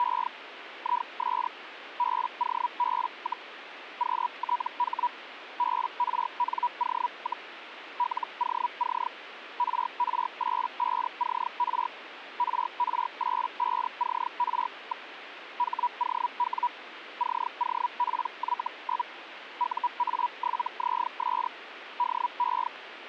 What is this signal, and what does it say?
Hellschreiber (Feld-Hell, 122.5 baud), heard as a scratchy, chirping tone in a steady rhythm, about 970 Hz, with radio static. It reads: … IS BOB, QTH BRNO, LOC RR85CR RR85CR. HOW COPY? UA7ZS DE